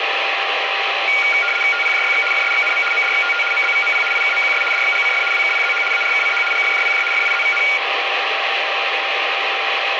RTTY (75 baud, 850 Hz shift), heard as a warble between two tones, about 1850 Hz centre, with radio static and a steady whistle near 790 Hz. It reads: TPJYX FSXNM MDXTT MBVMP IKMQS DXGCF WKPZH ARKCH GFJPJ FIZVN